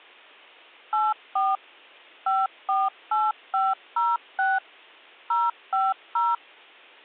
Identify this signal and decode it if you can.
DTMF, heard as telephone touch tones, dialled by machine, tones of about 200 ms. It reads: 84 548506 050